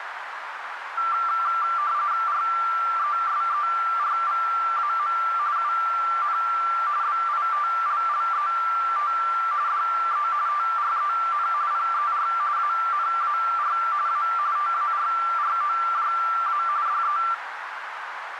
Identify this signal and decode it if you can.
RTTY (45.45 baud, 170 Hz shift), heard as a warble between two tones, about 1260 Hz centre, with radio static and a narrow filter. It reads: RESERVAM UN BITLLET DE TREN PER ANAR A TARROJA DE